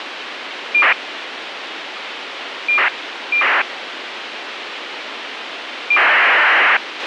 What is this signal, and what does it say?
ACARS aircraft data, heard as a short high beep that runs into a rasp, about 2400 baud, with radio hiss and a squelch burst at the end.